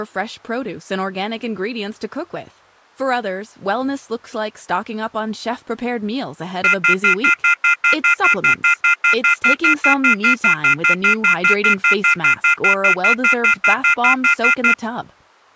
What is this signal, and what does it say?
Telephone call progress tone (North American plan), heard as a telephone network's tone, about 1400, 2050, 2450, 2600 Hz, 0.1 s on and 0.1 s off, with speech in English. Off-hook warning tone.